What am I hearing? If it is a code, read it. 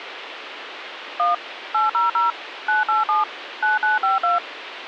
DTMF, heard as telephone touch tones, dialled by machine, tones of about 150 ms, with phone line noise. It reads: 1 800 987 9952